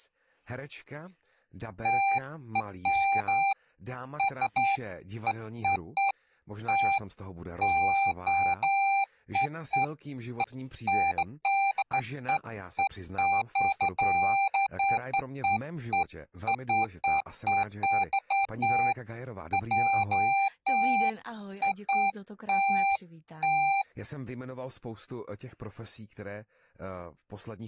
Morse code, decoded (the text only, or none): none